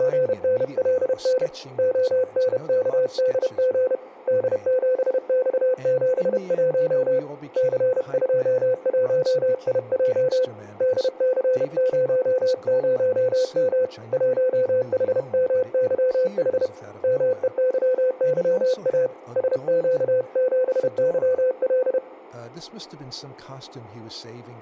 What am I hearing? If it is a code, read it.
Morse code, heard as a keyed tone, hand-sent with a paddle, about 31 wpm, 510 Hz, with speech in English. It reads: … ONKDG D7X71 C21IJ DC00M 1HMYH MEYYA SQ7YL